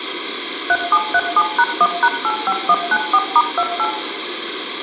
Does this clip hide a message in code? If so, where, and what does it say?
Yes: DTMF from 0.7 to 3.9 s, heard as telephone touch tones, dialled by machine, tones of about 60 ms, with radio hiss and room echo. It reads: 3737#1#85194*28